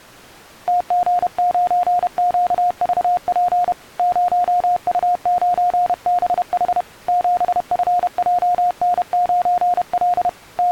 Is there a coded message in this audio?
Yes: Morse code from 0.6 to 10.7 s, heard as a keyed tone, hand-sent with a paddle, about 31 wpm, 710 Hz. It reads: TG9QVP 0U9BH 7FJN9L …